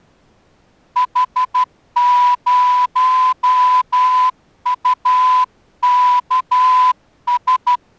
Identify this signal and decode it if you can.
Morse code, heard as a whistle, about 12 wpm. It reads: H0UKS